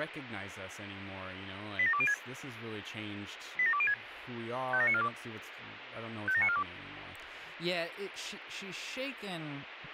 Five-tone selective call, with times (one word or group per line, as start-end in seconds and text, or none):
1.8-2.1 87206
3.6-3.9 87206
4.7-5.1 57942
6.3-6.6 57942